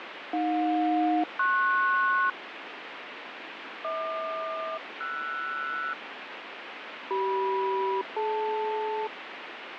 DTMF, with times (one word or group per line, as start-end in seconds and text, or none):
none